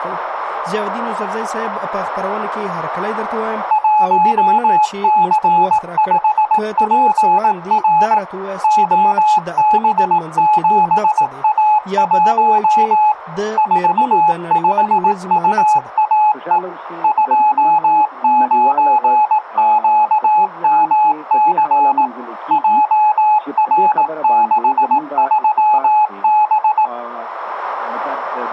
Morse code, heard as a keyed tone, machine-sent, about 18 wpm, 850 Hz. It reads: 1C5PR OB7A1 45UAE 29QMC JR63B